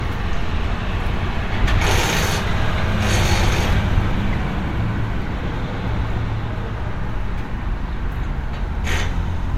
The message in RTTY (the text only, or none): none